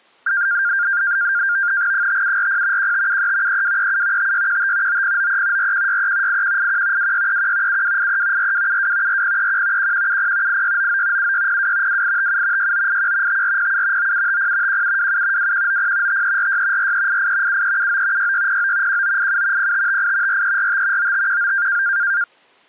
NAVTEX (SITOR-B), 100 baud, 170 Hz shift, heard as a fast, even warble, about 1500 Hz centre. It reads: 5740 1573 3237 5615 9093 4163 8181 2631 7283 4272 4031 1170 8699 7602 2857 6981 5407 9750 1727 2190 5346 4388 7379 6609 1987 0558 4345 9519